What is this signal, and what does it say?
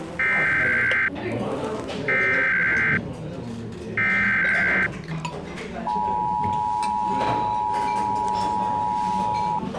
Emergency Alert System (SAME) tones (header bursts, then the 853 and 960 Hz attention tone), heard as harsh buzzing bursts, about 520.83 baud, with the noise of a crowd indoors.